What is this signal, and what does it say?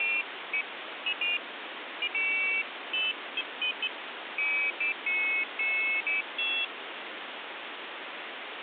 Pairs of high tones at irregular times, with phone line noise. There is no code.